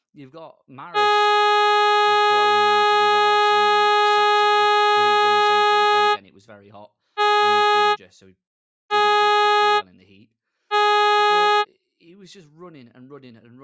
Ship horn signal, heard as a ship's horn, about 420 Hz, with speech in English. 1 long, 3 short. At sea: a vessel under tow in fog.